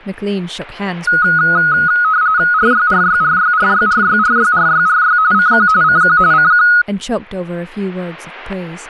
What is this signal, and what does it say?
RTTY (45.45 baud, 170 Hz shift), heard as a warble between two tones, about 1360 Hz centre, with static crashes and speech in English. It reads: RYRYRYRYRYRYRYRY CQ CQ CQ